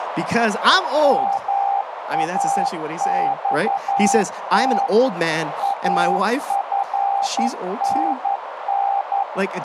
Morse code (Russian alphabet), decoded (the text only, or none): МАЬТ АФНН